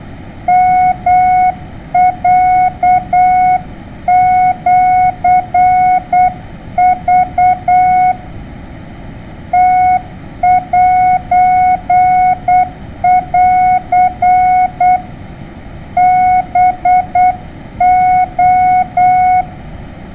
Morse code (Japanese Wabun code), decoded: ヨロシク ムセン ハレ

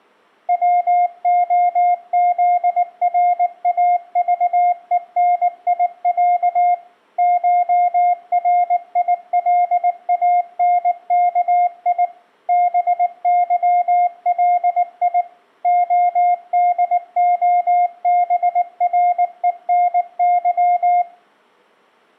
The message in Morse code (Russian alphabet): ВОЗРАЖЕНИЯ ШРИЛАНКИ БЫЛИ ОДОБРЕНЫ

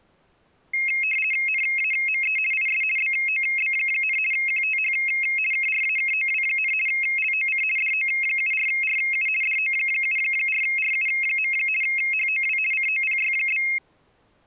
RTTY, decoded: NAME IS BOB, QTH KRAKOW, LOC DO74RU DO74RU. HOW COPY?

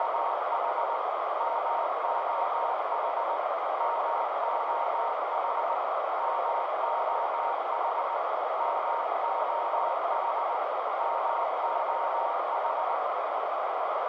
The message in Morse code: … MOH MOH MOH MOH MOH

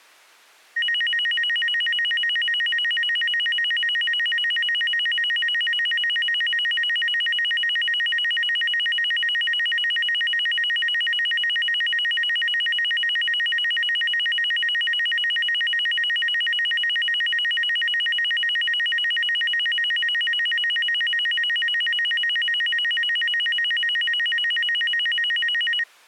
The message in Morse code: none

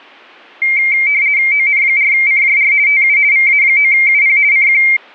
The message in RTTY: ON4CJR TU VA9UP CQ

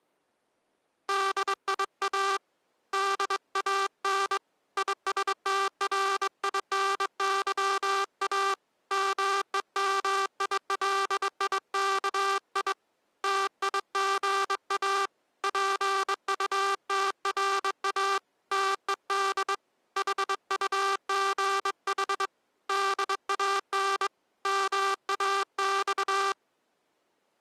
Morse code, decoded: DIA DAN ISTRINYA MEMILIKI TIGA PUTRA TED HUGH DAN MAX

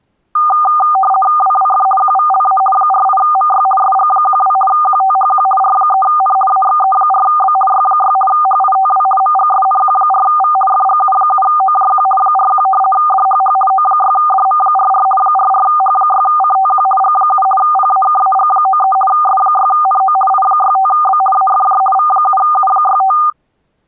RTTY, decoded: WWF QVLA 48MY SG12 QTHQ R3N AXE4B Y6 HITW MGSNQ4V FGU7OJQ 41 DHH O6DM44 44H6CTQ G7 PAKAG93 S6NO I65B AFJ V7U65

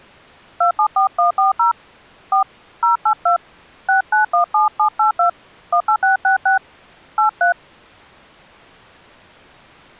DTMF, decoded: 274140 4 082 6917782 18666 83

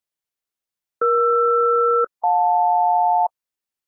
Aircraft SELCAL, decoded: ER-JL

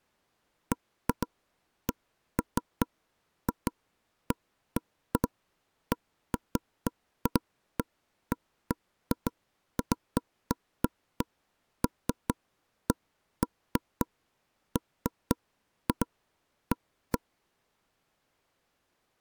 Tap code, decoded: none

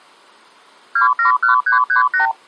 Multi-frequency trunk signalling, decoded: 271338

